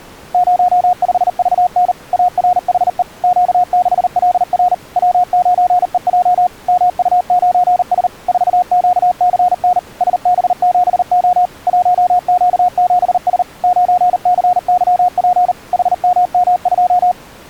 Morse code, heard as a keyed tone, machine-sent, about 39 wpm, 720 Hz. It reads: 05VN ARHE Q6LR W9EJ MU9S 4QCN SB7O 1Q7S 9CYP HMM2